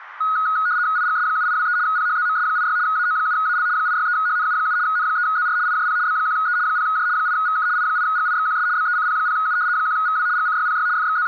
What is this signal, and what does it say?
RTTY (75 baud, 170 Hz shift), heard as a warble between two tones, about 1360 Hz centre, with radio static. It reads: IGS7823 PHZMS86 AO7AL 863HNU7 N3ZR IJP B1E 0J 8VK I8GIXQS BECP0U 1VW GCYPY …